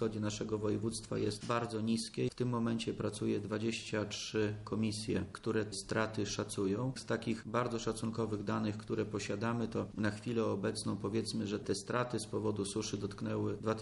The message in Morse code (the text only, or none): none